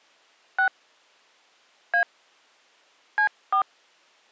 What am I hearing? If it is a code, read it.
DTMF, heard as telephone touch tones, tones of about 90 ms. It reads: 6 A C4